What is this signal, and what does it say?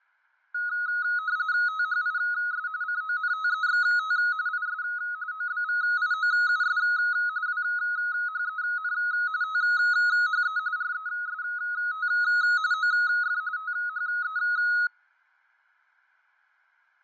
RTTY (45.45 baud, 170 Hz shift), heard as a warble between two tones, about 1360 Hz centre, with fading. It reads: THIS CONTEXT IS OBVIOUS WHEN THE REST OF THE